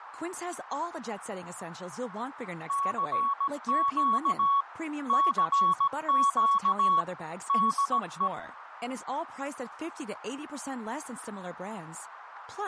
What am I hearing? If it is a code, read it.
Morse code, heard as a keyed tone, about 17 wpm, 1120 Hz, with radio static, a narrow filter and speech in English. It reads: CQ CQ DE